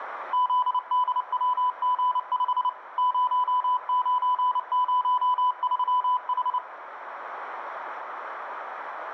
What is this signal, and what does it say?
Morse code, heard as a keyed tone, machine-sent, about 29 wpm, 1000 Hz, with radio static and room echo. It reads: ZDWG5 0903H